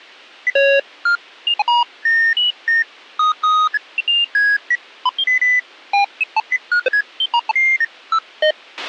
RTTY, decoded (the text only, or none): none